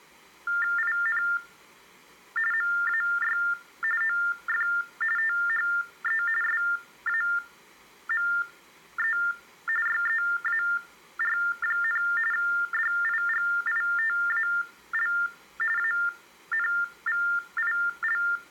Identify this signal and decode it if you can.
TTY/TDD text telephone tones (45.45 baud Baudot), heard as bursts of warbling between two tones, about 400 Hz shift, 1600 Hz centre. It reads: IN MAY OF THE SAME YEAR, DIGITAL ANVIL